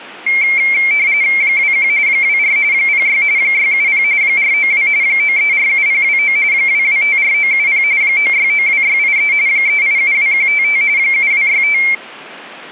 RTTY (45.45 baud, 170 Hz shift), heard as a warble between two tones, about 2250 Hz centre. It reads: 21 24 06 670 492 9347029 2254970 9692683 3872155 7265